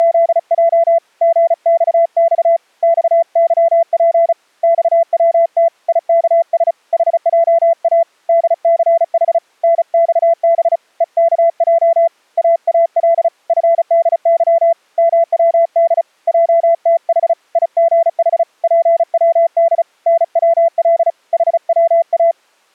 Morse code, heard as a keyed tone, hand-sent with a paddle, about 35 wpm, 670 Hz. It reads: … GXX XYP XWT IKS HJA DCH NXB EKJ AAL FDY MWD JTH IGH PWD NWL HWA